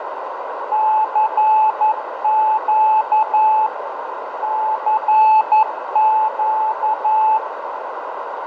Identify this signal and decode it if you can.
Morse code, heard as a keyed tone, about 11 wpm, 870 Hz, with radio static, fading and a narrow filter. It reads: CQ CQ